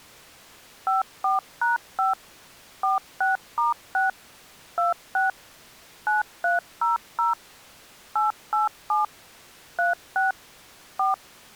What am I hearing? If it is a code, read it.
DTMF, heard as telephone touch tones, dialled by machine, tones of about 150 ms. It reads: 54#5 46*6 26 9300 887 36 4